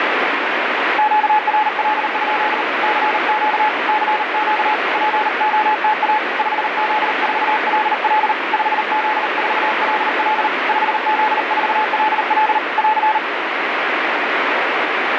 Morse code, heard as a keyed tone, hand-sent with a paddle, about 39 wpm, 860 Hz, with heavy radio static. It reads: QRL? CQ CQ POTA 5Z4LL 5Z4LL 5Z4LL <AR>